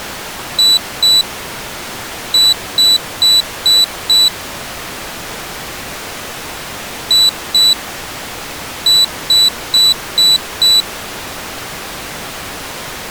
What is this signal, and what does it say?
Beep code, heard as a piezo beeper, played twice, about 3950 Hz. 2-5.